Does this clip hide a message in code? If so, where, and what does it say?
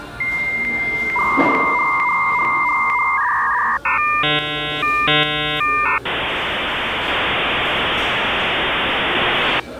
Yes: dial-up modem handshake (V.34 or later) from 0.2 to 9.6 s, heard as a whistle, warbles, then hiss, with the noise of a cafe.